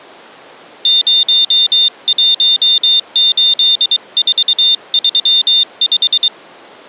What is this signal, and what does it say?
Morse code, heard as a high beeper, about 23 wpm, 3600 Hz. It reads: 018435